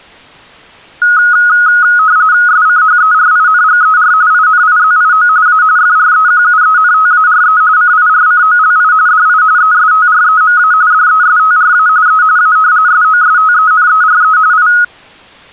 RTTY (45.45 baud, 170 Hz shift), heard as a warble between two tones, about 1360 Hz centre. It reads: SCHERINGER INIZIO A FREQUENTARE CIRCOLI DI ESTREMA DESTRA E A SOSTENERE I